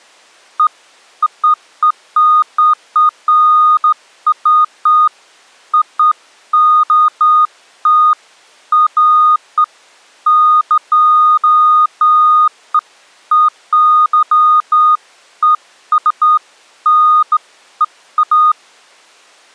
Beeps of irregular length. There is no code.